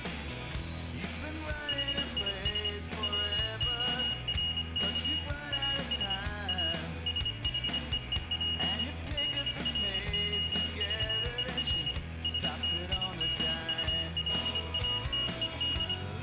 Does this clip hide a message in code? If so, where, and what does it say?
Yes: Morse code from 1.6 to 16.0 s, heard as a high beeper, machine-sent, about 25 wpm, 2900 Hz, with room echo. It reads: HIS WORK AS A SHEEP DROVER STIMULATED